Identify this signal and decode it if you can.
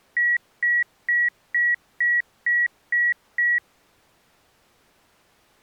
Beep code, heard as beeps, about 1900 Hz. 8 short. In AMI BIOS tables: display memory failure; in Dell tables: LCD failure.